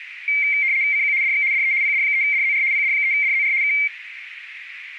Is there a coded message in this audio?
Yes: RTTY (75 baud, 170 Hz shift) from 0.3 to 3.9 s, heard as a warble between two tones, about 2200 Hz centre, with radio static and a narrow filter. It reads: CQ DX DE PD3DZR PD3DZR K